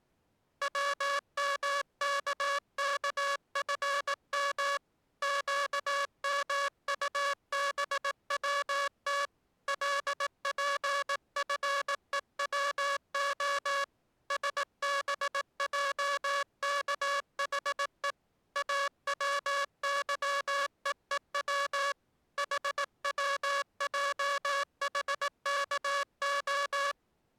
Morse code, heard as a buzzer, hand-sent with a paddle, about 18 wpm. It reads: WMKKFM QMUBWT LPFEWO SBJKHE AWYEEW HWJHKO